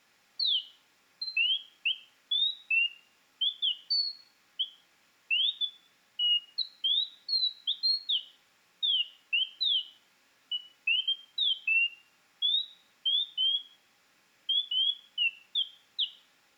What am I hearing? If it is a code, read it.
Bird-like chirps, with room echo. There is no code.